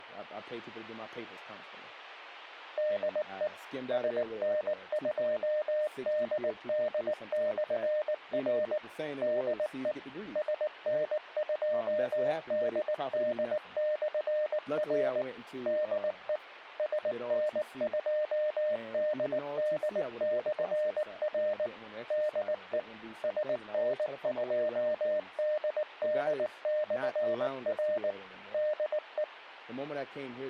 Morse code, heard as a keyed tone, machine-sent, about 19 wpm, 610 Hz, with speech in English. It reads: DE SN2DD/R DE SN2DD/R DE SN2DD/R DE SN2DD/R DE